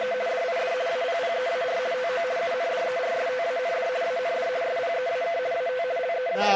RTTY (50 baud, 170 Hz shift), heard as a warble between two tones, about 590 Hz centre. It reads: … DID APPEAR TO UNDERSTAND AND SPEAK AT …